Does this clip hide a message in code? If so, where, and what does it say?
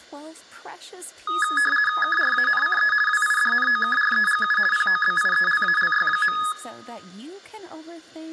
Yes: RTTY (50 baud, 450 Hz shift) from 1.3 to 6.5 s, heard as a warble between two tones, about 1470 Hz centre, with speech in English. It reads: KRANCE WIDNOKREGU POBIELALY.